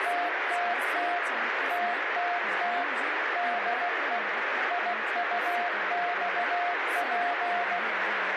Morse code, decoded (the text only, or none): TTT TTT DE IUXP